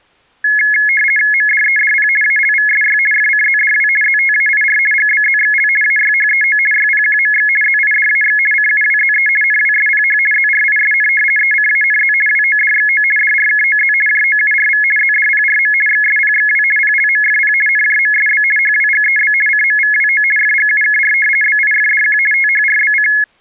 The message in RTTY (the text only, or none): MDEDP ALVSY FCZDW ZTAIR GBZXL AYHEO YPQMX ZIDAX CUWZE NWSPH ZRISN ECANZ WODXO DRKOZ JOURV ZDPRM XSPXW PLMFP NJMSB HWGEB CMVWO FGUKR BIFDQ THRBC